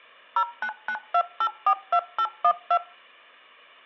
DTMF, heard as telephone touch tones, dialled by machine, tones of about 70 ms. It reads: 0992842812